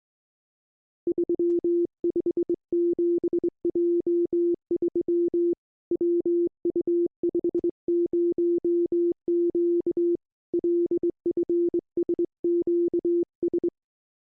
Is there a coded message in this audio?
Yes: Morse code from 1.0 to 13.7 s, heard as a keyed tone, hand-sent with a straight key, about 22 wpm, 340 Hz. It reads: 357J3 WU50Q LFSQS